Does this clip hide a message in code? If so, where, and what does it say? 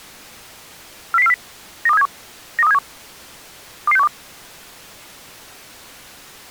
Yes: five-tone selective call (EEA) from 1.1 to 4.1 s, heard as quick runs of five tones, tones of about 40 ms. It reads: 40040 92371 92371 22612